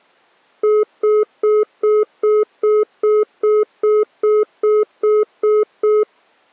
Telephone call progress tone (single-tone plan, as in most of Europe), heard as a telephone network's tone, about 420 Hz, 0.2 s on and 0.2 s off. Congestion tone.